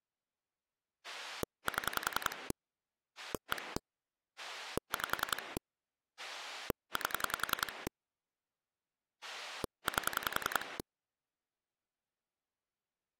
Pulse dialling, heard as a rotary dial, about 10 pulses a second. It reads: 7 1 5 8 8